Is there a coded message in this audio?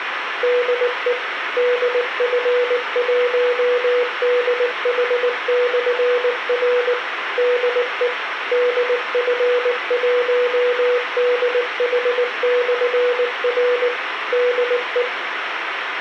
Yes: Morse code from 0.4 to 15.1 s, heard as a keyed tone, machine-sent, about 19 wpm, 490 Hz, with radio hiss and room echo. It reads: DE DF1DH/R DE DF1DH/R DE